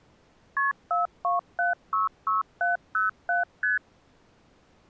Multi-frequency trunk signalling (R1, as on North American trunks), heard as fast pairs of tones, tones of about 150 ms. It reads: KP 42766707 ST